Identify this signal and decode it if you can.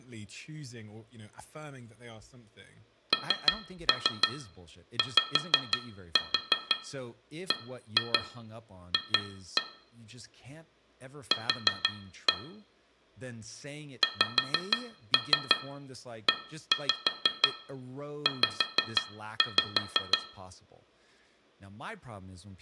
Tap code, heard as taps on glass, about 6 knocks a second, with room echo and speech in English. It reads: NYBF Q XEZ